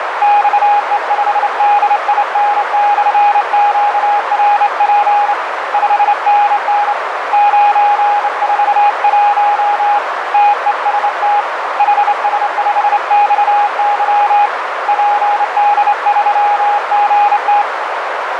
Morse code, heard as a keyed tone, hand-sent with a straight key, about 28 wpm, 820 Hz, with heavy radio static and a narrow filter. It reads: XE5DIN/QRP 5NN 941 TEST HS5XY PD3GT